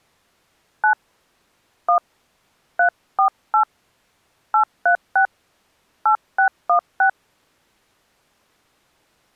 DTMF, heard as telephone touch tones, dialled by hand, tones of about 100 ms. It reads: 9 1 348 836 8616